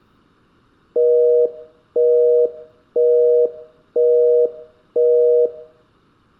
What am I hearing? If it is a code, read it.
Telephone call progress tone (North American plan), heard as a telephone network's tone, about 480, 620 Hz, 0.5 s on and 0.5 s off. Busy tone.